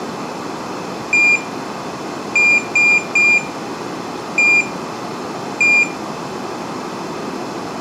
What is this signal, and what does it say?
Beep code, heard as a piezo beeper, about 2400 Hz, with room echo. 1-3-1-1. In Phoenix BIOS tables: memory refresh test failure.